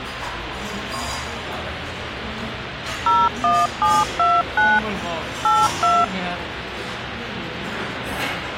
DTMF, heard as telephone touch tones, dialled by machine, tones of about 220 ms, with phone line noise and the noise of a restaurant. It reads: 01729 82